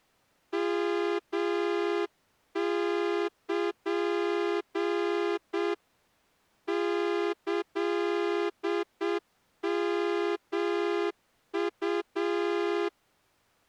Morse code (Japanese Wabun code), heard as a horn, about 7 wpm. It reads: ヨル キヨウ